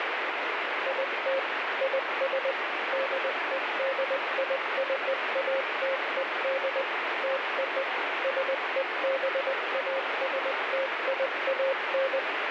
Morse code (American railroad code), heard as a keyed tone, machine-sent, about 540 Hz, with heavy radio static. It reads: IT IS DEDICATED TO SEBASTIAN